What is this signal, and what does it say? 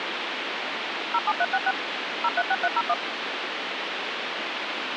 DTMF, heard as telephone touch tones, dialled by machine, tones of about 50 ms, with phone line noise. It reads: 07366 036301